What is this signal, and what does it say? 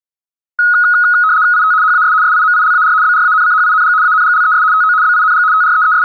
RTTY (75 baud, 170 Hz shift), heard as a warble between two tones, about 1360 Hz centre, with room echo. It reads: IT HAS SIMILAR BRANCHING ANGLES TO BING …